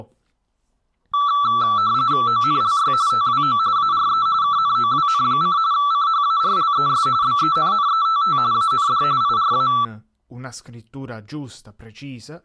RTTY (45.45 baud, 170 Hz shift), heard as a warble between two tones, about 1240 Hz centre, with speech in Italian. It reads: ONLY TWO ARE KNOWN: CHARLES BENNETT AND IRA